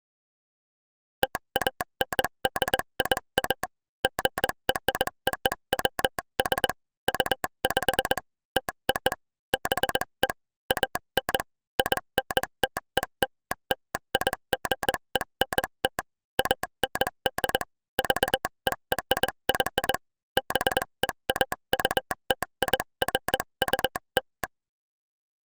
Morse code (American railroad code), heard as a telegraph sounder, hand-sent with a straight key. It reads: TANDIA GROWS UP TO BE AN INTELLIGENT AND VERY BEAUTIFUL